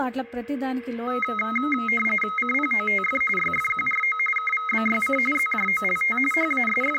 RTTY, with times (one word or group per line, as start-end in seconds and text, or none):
2.4-3.2 CPOTF
3.4-4.2 YFQRO
4.4-5.2 KVBYC
5.3-6.2 ZJOLT
6.3-7.0 …